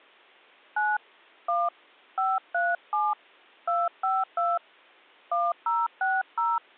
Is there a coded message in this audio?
Yes: DTMF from 0.8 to 6.6 s, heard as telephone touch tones, dialled by hand, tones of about 210 ms. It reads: 9 1 537 252 1060